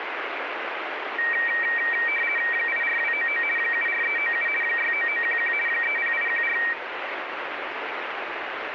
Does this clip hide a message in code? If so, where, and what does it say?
Yes: RTTY (50 baud, 450 Hz shift) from 1.2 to 6.7 s, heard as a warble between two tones, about 2100 Hz centre, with radio static. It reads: 84299 74397 69911 30814